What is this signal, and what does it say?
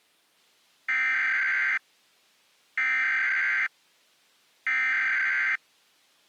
Emergency Alert System (SAME) tones (header bursts), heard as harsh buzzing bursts, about 520.83 baud.